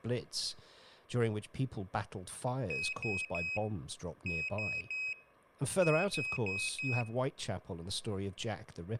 Beep code, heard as a piezo beeper, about 2550 Hz, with speech in English. 3-3-4. In Phoenix BIOS tables: video failure.